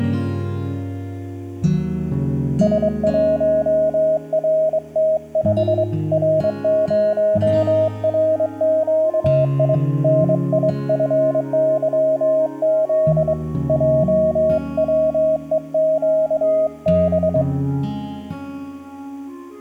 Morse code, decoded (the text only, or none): S1RT5 R0RQI NIFYZ JWEQB